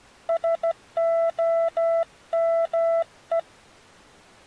Morse code, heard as a keyed tone, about 14 wpm, 660 Hz. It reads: SOME